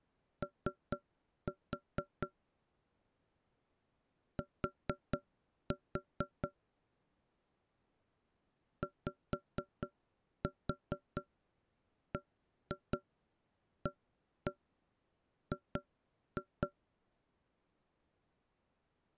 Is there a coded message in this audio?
Yes: tap code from 0.4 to 16.7 s, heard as knocks on wood, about 4 knocks a second. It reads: O T YBAG